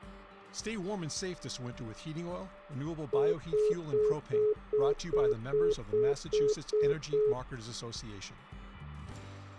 Telephone call progress tone (single-tone plan, as in most of Europe), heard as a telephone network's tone, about 420 Hz, 0.2 s on and 0.2 s off. Congestion tone.